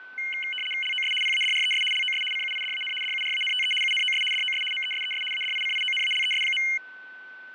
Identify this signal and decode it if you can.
RTTY (75 baud, 850 Hz shift), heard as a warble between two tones, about 2550 Hz centre, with fading and a steady whistle near 1510 Hz. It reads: LOS PADRES LOS CUIDAN DURANTE UNOS DOS MESES ADICIONALES.